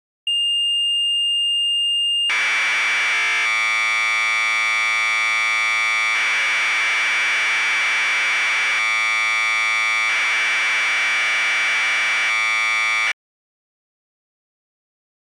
Commodore tape loading (standard loader), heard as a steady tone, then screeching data.